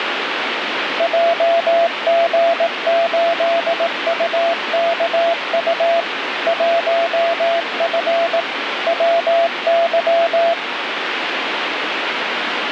Morse code, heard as a keyed tone, machine-sent, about 18 wpm, 680 Hz, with radio static. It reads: JG8UKU 1F WY